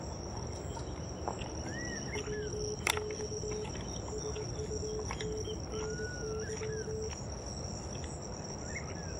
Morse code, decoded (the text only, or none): WX SUNNY